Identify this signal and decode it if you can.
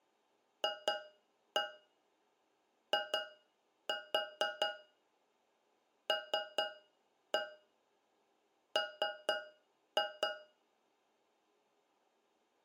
Tap code, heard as taps on a metal pipe, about 4 knocks a second, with room echo. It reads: FILM